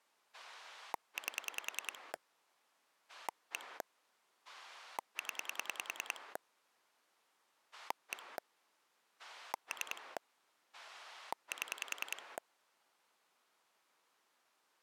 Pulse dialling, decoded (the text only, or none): 8 1 0 1 3 7